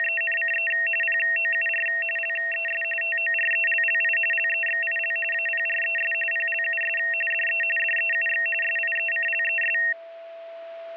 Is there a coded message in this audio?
Yes: RTTY (45.45 baud, 850 Hz shift) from 0.0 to 9.9 s, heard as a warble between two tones, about 2300 Hz centre, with a steady whistle near 670 Hz. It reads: … POUR LES TORELLI LEXIL APRES PLUS DE DEUX SIECLES